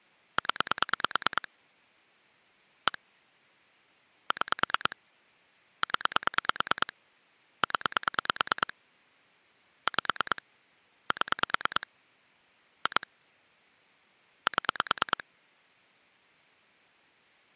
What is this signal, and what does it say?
Pulse dialling, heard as clicks on a phone line, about 9 pulses a second. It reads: 0 1 6 0 0 5 7 2 7